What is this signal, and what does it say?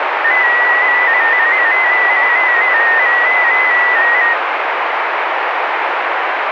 Multi-tone FSK (Olivia or MFSK type), about 250 Hz wide, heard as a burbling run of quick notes, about 15.625 baud, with radio static.